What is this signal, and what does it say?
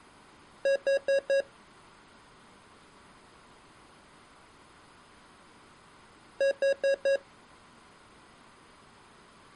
Alarm pattern, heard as an alarm's beeps, played twice, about 550 Hz. Temporal four. Carbon monoxide.